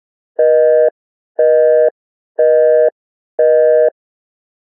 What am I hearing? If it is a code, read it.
Telephone call progress tone (North American plan), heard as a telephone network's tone, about 480, 620 Hz, 0.5 s on and 0.5 s off. Busy tone.